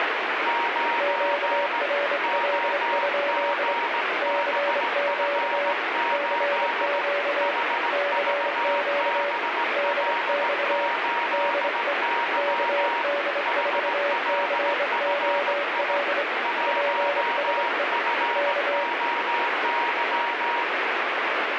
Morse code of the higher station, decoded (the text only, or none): 9 OGBF8 HVBL8Y HLFI 1FOY